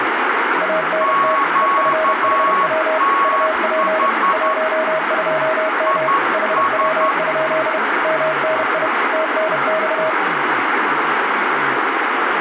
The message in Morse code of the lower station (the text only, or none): ANT EFHW UP 12M HW? MNI TNX